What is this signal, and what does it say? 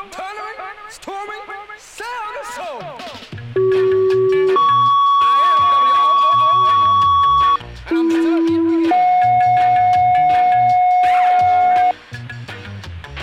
Two-tone page, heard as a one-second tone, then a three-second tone, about 380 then 1120 Hz, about 330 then 730 Hz, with a squelch burst at the end.